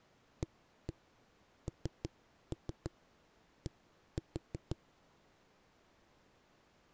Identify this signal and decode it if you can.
Tap code, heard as knocks on a wall, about 6 knocks a second. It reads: AND